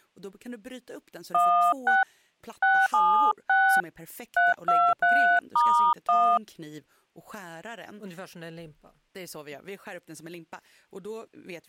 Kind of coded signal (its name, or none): DTMF